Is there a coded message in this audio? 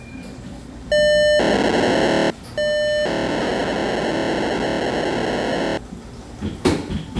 Yes: POCSAG pager data (1200 baud) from 0.9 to 5.8 s, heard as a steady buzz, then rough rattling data, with the noise of a cafe.